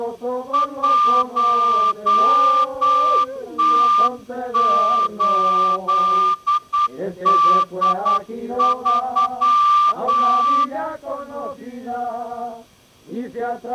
Morse code, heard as a whistle, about 9 wpm. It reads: 1T8D3